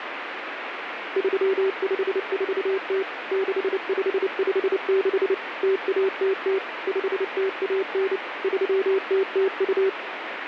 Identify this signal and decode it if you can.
Morse code (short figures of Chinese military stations), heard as a keyed tone, machine-sent, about 29 wpm, 390 Hz, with radio static. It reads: 3540 6556 0100 5019 3002